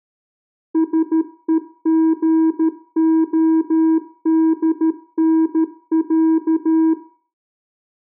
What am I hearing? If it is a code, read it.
Morse code (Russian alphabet), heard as a keyed tone, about 13 wpm, 320 Hz, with room echo. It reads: СЕГОДНЯ